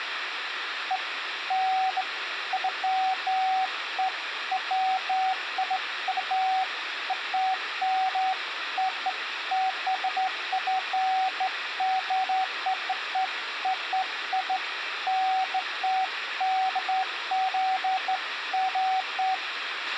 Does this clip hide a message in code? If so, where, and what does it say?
No, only beeps of irregular length, with radio hiss, a squelch burst at the end and room echo.